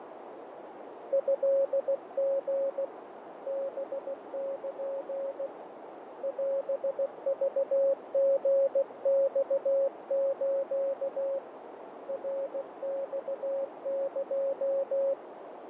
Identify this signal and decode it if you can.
Morse code (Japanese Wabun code), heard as a keyed tone, hand-sent with a paddle, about 16 wpm, 550 Hz, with radio static, fading and a narrow filter. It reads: トリ ハル オクリマス ナマエ